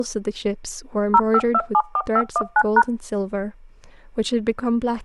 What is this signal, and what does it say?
DTMF, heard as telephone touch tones, dialled by machine, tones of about 60 ms, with speech in English. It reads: 05274519#